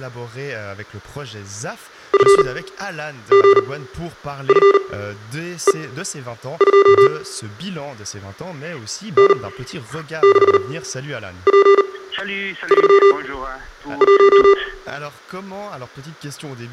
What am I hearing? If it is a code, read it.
Morse code, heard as electronic beeps, machine-sent, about 39 wpm, spaced as for 9 wpm, 400 Hz, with room echo. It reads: FGFE2 N6P31